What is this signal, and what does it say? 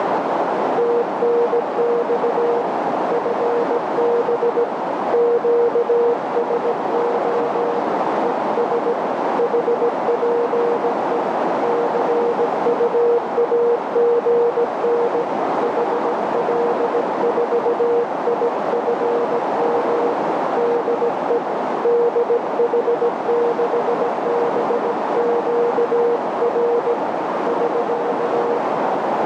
Morse code, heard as a keyed tone, hand-sent with a paddle, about 17 wpm, 470 Hz, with heavy radio static and a narrow filter. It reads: TNX FB QSO ES HPE CUAGN HL4IFM DE DH6BQR <SK>